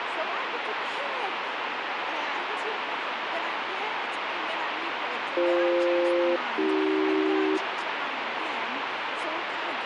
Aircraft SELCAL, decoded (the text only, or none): BF-AC